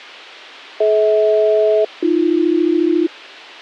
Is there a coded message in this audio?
Yes: aircraft SELCAL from 0.8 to 3.1 s, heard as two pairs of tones. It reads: DH-AB